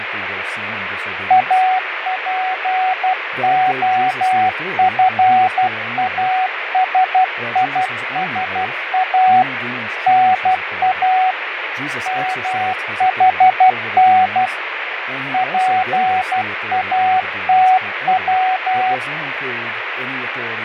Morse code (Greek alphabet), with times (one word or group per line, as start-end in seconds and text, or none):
1.3-9.4 ΑΠΟΦΑΣΙΣΑ
10.1-11.3 ΝΑ
12.1-14.5 ΜΗΝ
15.3-18.9 ΠΑΤΩ